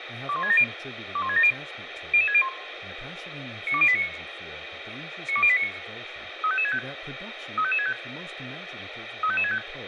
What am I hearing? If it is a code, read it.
Five-tone selective call (ZVEI), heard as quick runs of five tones, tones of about 70 ms, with radio hiss and speech in English. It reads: 21670 21670 00601 92089 92089 35565 35565 35565